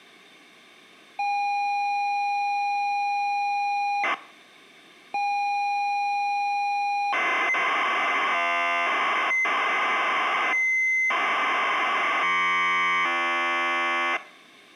ZX Spectrum tape loading, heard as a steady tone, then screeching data.